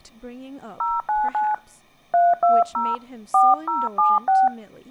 DTMF, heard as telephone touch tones, dialled by hand, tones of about 200 ms, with speech in English. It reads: 099 320 4076